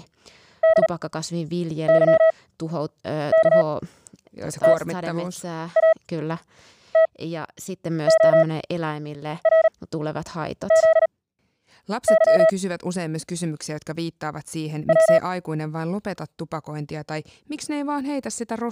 Morse code, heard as a keyed tone, machine-sent, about 38 wpm, spaced as for 8 wpm, 650 Hz, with speech in Finnish. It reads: DYKTATORZY W